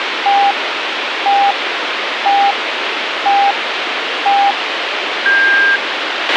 Radio time signal (five pips and a higher one, as on Chinese radio), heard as pips, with radio hiss and a squelch burst at the end.